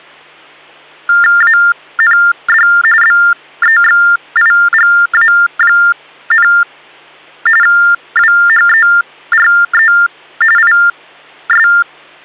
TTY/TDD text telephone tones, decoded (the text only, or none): AND BEXIGA, WHERE IS